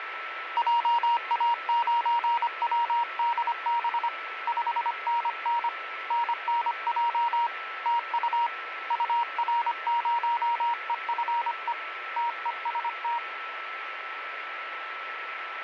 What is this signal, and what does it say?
Morse code, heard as a keyed tone, hand-sent with a paddle, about 25 wpm, 940 Hz, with radio static and a steady whistle near 1320 Hz. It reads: JA9WDB 5NN NNJ TU UR0EFE TEST